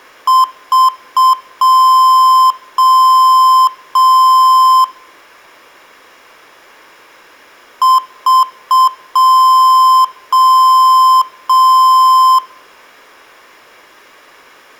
Beep code, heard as beeps from a small speaker, played twice, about 1040 Hz, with room echo. 3 short, 3 long.